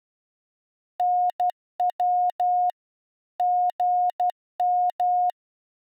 Morse code, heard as a keyed tone, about 12 wpm, 720 Hz. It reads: NW GM